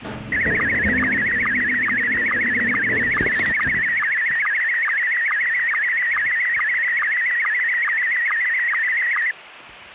SSTV (slow-scan television), Scottie S1, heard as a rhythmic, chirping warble, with the noise inside a lift.